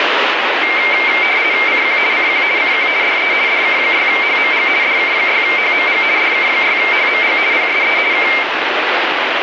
RTTY (50 baud, 170 Hz shift), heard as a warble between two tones, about 2200 Hz centre, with radio static. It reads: CQ CQ CQ DE DK6HMG DK6HMG DK6HMG PSE K